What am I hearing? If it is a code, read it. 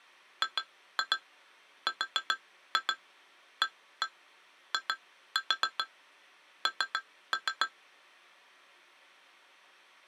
Tap code, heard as taps on glass, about 7 knocks a second. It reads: GRAIN